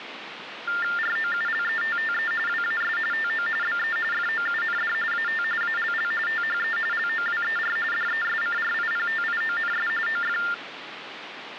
TTY/TDD text telephone tones (45.45 baud Baudot), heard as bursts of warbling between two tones, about 400 Hz shift, 1600 Hz centre, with phone line noise. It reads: ROULETTE WAS TO BE FOUND AT ALL THE LOWER DESCRIPTIONS OF